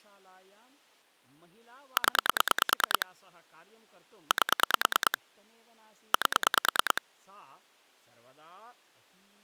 Pulse dialling, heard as clicks on a phone line, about 9 pulses a second, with speech in Sanskrit. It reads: 0 8 8